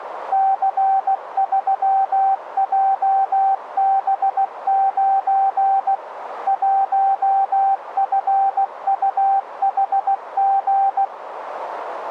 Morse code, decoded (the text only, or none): C3JB9 1FUHG